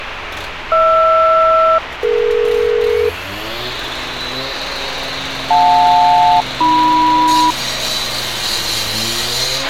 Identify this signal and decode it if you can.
Aircraft SELCAL, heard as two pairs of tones, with radio hiss, a squelch burst at the end and street noise. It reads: HR-DE JL-AM